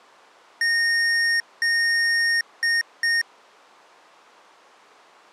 Beep code, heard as beeps from a small speaker, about 1850 Hz. 2 long, 2 short.